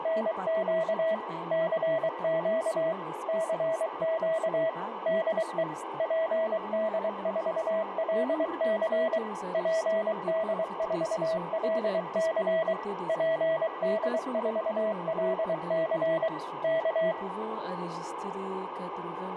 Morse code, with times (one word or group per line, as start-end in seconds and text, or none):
0.0-1.1 …
1.5-2.9 CQ
3.3-4.7 CQ
5.1-5.6 DE
6.0-9.2 PD4LC
9.5-12.7 PD4LC
13.1-16.3 PD4LC
16.6-17.1 K